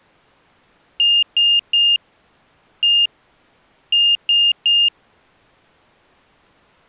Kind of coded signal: beep code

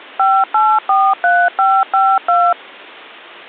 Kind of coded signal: DTMF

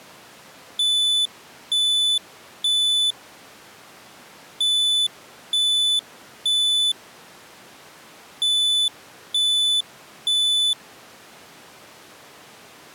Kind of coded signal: alarm pattern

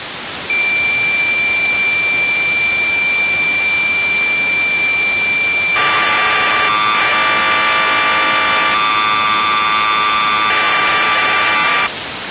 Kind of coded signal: cassette data (Kansas City type)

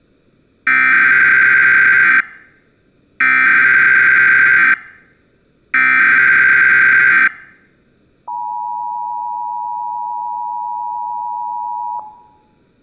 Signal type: Emergency Alert System (SAME) tones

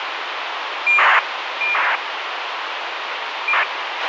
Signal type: ACARS aircraft data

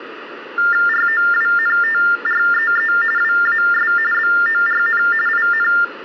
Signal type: TTY/TDD text telephone tones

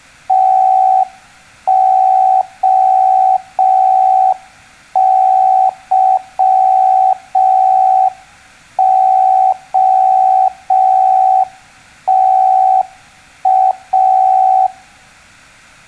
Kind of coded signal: Morse code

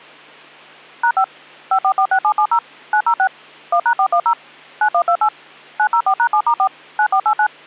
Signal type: DTMF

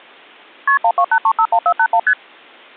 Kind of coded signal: multi-frequency trunk signalling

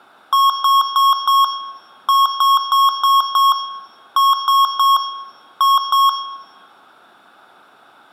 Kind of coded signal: beep code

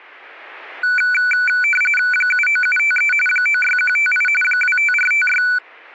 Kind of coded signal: RTTY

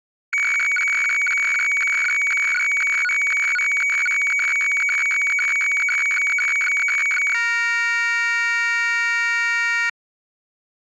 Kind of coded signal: weather fax (radiofax)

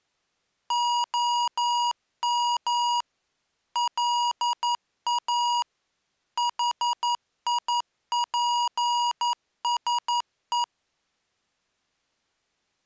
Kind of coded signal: Morse code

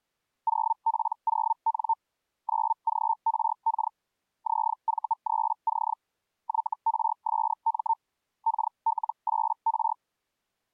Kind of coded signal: Hellschreiber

